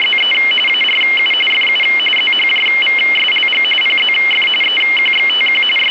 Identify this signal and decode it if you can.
RTTY (45.45 baud, 850 Hz shift), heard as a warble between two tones, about 2550 Hz centre, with radio static. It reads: … ARU FU ZHJVSLG PZF EQXTQ …